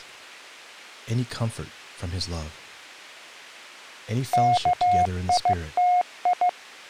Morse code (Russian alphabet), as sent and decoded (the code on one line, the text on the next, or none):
-.- .. - ..
КИТИ